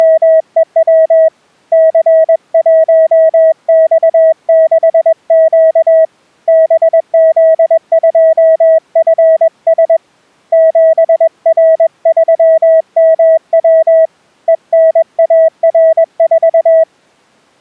Morse code, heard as a keyed tone, hand-sent with a paddle, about 21 wpm, 640 Hz. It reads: … C1X6Q BZ2FS 7R3MW ENAR4